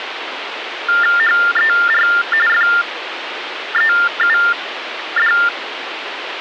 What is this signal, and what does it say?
TTY/TDD text telephone tones (45.45 baud Baudot), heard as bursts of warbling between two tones, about 400 Hz shift, 1600 Hz centre, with phone line noise. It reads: HER FEUD